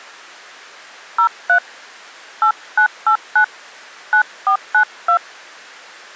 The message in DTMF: 03 8989 9492

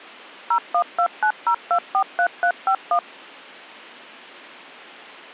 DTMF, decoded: 01290243351

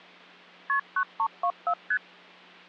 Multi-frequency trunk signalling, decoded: KP 9324 ST

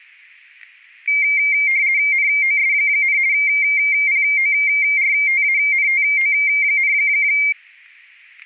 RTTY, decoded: NOS, PORTANTO,

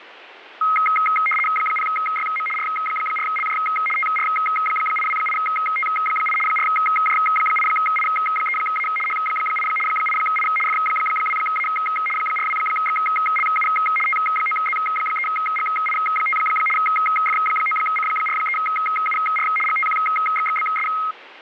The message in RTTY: 0YM R4LJ TR828T8 4J8I3A H8 8I F2A 42XLU T9Z3GI5 F9C43UR GTQXXBS

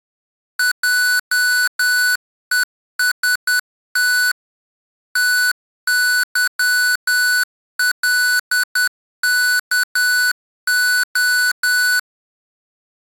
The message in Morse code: JEST TYLKO

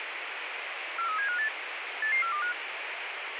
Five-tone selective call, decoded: 43758 88425

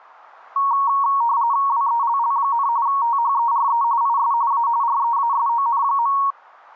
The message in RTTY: WELL, THERE IS A REASON.

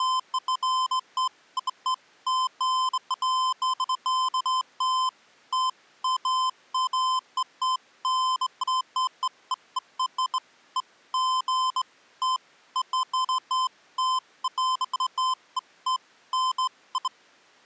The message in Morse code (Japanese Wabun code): none

